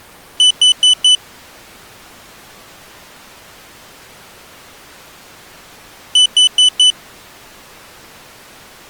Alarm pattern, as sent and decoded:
4 beeps and a pause
temporal four

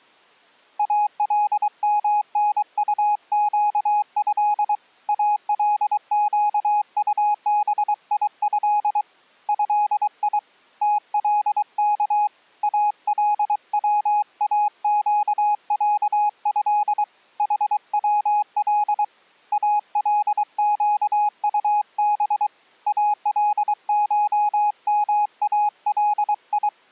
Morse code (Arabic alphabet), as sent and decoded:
.- .-.. -- -. ..- --.- ..-.. / .- .-.. --.- ..- -... .. ..-.. / ..-.. .. / - .-.. -.- / .- .-.. .-- .- --.- .-.- ..-.. / .... .-- .-.. / .- .-.. --.- ..- -... / .- .-.. ---- -- .- .-.. ..
المنطقه القطبيه هي تلك الواقعه حول القطب الشمالي

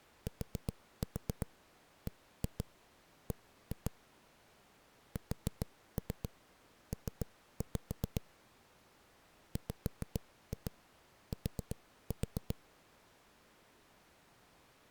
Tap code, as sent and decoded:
4-4 1-2 1-2 / 4-3 3-5 / 5-2 4-4
TBB SP WT

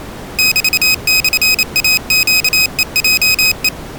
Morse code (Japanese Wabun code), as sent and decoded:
-...- -..-. .- --.- . .--- .
メモイネヘヲヘ

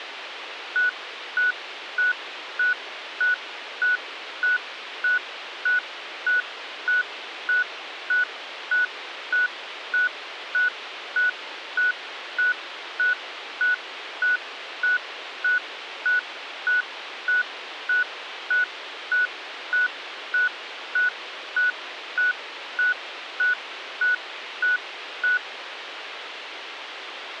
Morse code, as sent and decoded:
none

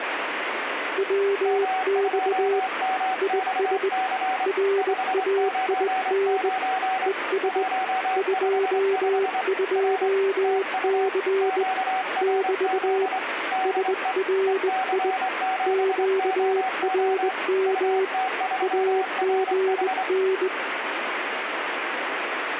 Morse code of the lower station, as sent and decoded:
.-- -..- / .. ... / .-. .- .. -. / . ... / ..--- ..--- -.-. / -...- / ... .-. .. / --.- .-. -- / .- --. -.
WX IS RAIN ES 22C <BT> SRI QRM AGN

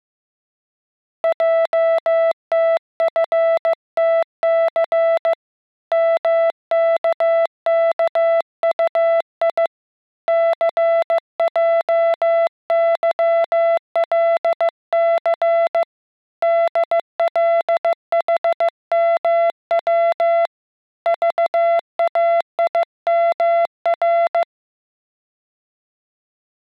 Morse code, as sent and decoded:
.--- - ..-. - -.-. / -- -.- -.- ..- .. / -.-. .--- -.-- .-.. -.-. / -.. .-.. .... -- .-- / ...- .- .. -- .-.
JTFTC MKKUI CJYLC DLHMW VAIMR

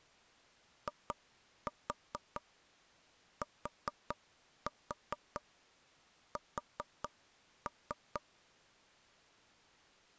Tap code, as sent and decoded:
2-4 4-4 4-3
ITS

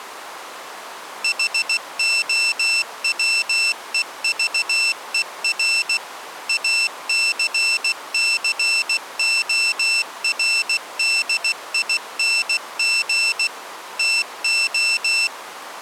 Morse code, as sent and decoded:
.... --- .-- . ...- . .-. / .- -.-. -.-. --- .-. -.. .. -. --. / - ---
HOWEVER ACCORDING TO

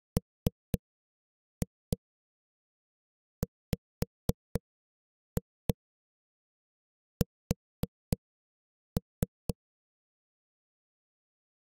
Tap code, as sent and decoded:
3-2 5-2 4-3
MWS

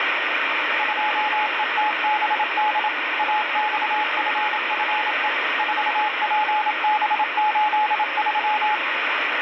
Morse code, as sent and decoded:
..--- . - -... -.. / .- -..- ..-. ..-. . / ....- .--. -... ---.. ...--
2ETBD AXFFE 4PB83

